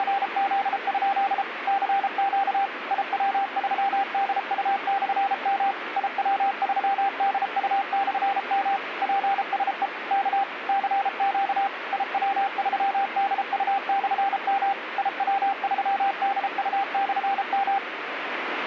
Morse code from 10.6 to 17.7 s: CQ IW3DU/M IW3DU/M

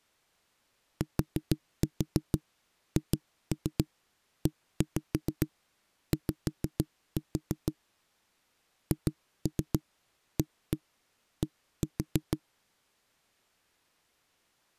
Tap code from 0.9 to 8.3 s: THEY

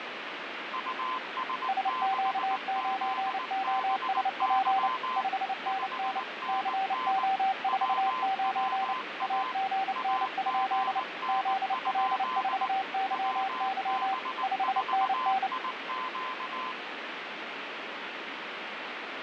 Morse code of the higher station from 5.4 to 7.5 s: 5NN

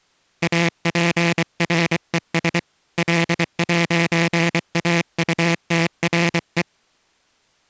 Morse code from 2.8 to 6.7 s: L'AUTRE

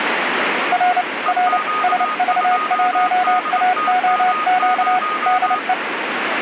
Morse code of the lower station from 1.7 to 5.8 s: SV1AOQ DE

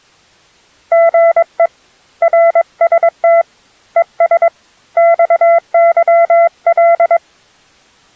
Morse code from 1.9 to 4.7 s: RST ES

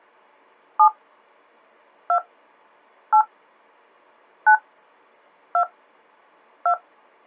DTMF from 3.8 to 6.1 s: 9 2

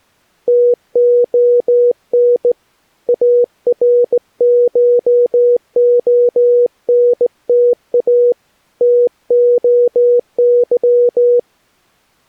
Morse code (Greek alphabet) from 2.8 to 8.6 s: ΑΡΧΟΝΤΑ

